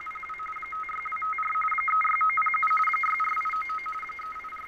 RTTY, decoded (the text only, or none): … 56254 36907 64899 …